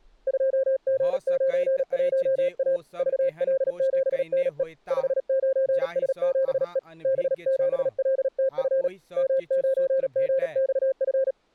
Morse code, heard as a keyed tone, hand-sent with a paddle, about 37 wpm, 530 Hz, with speech in Maithili. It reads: 2G91A VL7NE 59S7E B7LTF M9GXF